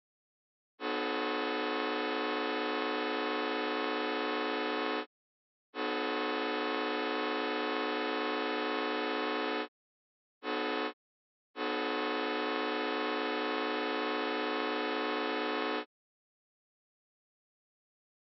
Train horn signal, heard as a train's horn. 2 long, 1 short, 1 long. On North American railways: approaching a public crossing.